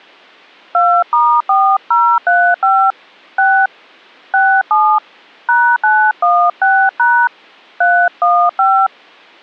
DTMF, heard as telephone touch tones, dialled by hand, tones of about 280 ms. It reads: 2*4035 6 67 #916# 315